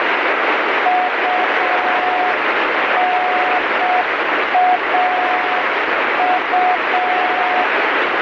Morse code, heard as a keyed tone, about 6 wpm, 730 Hz, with heavy radio static. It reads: UNAU